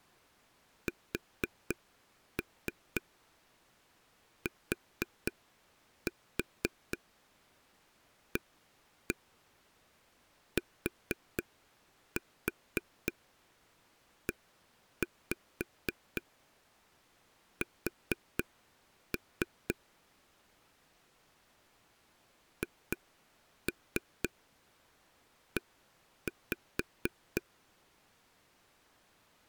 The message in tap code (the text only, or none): STATES HE